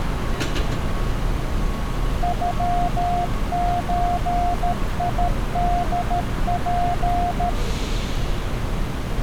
Morse code (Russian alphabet), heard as a keyed tone, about 13 wpm, 710 Hz, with street noise. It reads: ЮЧИДП